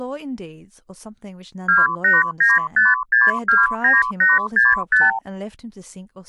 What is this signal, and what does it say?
Multi-frequency trunk signalling (R2, with the far end's replies), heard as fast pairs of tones, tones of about 180 ms, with speech in English. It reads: 2895629865